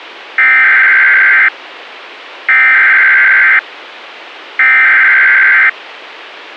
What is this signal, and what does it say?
Emergency Alert System (SAME) tones (header bursts), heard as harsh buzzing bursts, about 520.83 baud.